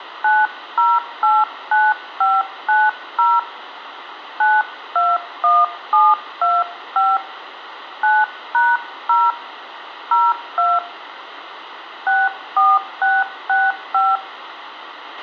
DTMF, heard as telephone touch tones, dialled by hand, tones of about 210 ms, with radio hiss and a squelch burst at the end. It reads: 9089590 921725 9#0 02 64665